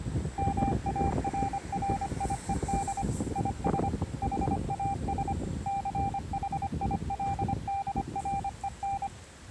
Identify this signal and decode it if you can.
Morse code, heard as a keyed tone, machine-sent, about 25 wpm, 790 Hz, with street noise. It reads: MARRIED IS HAS CHILDREN